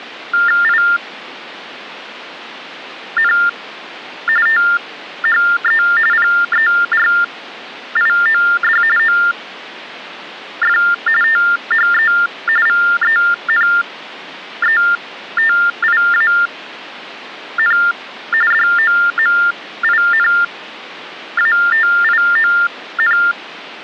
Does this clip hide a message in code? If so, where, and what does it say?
Yes: TTY/TDD text telephone tones (45.45 baud Baudot) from 0.3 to 23.3 s, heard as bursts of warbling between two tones, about 400 Hz shift, 1600 Hz centre. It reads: IN THE PERIOD OF THE VENETIAN DOMINATION